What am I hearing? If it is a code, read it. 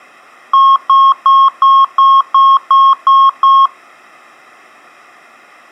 Beep code, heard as beeps, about 1080 Hz. 9 short. In AMI BIOS tables: ROM checksum failure.